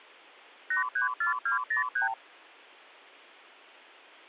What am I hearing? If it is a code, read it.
Multi-frequency trunk signalling (R2, with the far end's replies), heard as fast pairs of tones, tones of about 120 ms. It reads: 834203